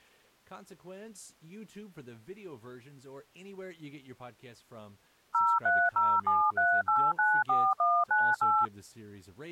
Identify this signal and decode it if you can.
DTMF, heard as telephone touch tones, dialled by machine, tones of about 240 ms, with speech in English. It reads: 03073894198